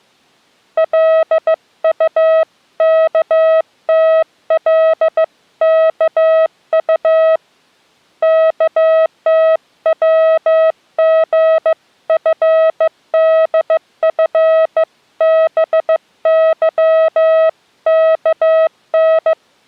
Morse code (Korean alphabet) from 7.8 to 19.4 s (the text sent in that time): 없는데요